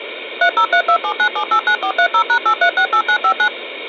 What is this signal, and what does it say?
DTMF, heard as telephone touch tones, dialled by machine, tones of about 80 ms. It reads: 303279789430#8368959